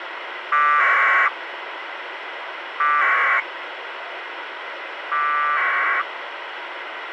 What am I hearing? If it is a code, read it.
Packet radio (AX.25, as in APRS), 1200 baud, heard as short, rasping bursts, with radio hiss.